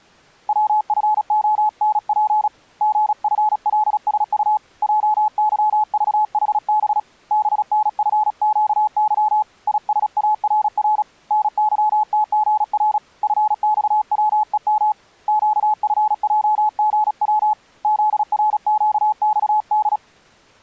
Morse code, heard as a keyed tone, hand-sent with a paddle, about 36 wpm, 850 Hz. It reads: WFONP GFLSU JYVHB BNFQY ISARR NYTGR FXWEM QFJGW ZRQXD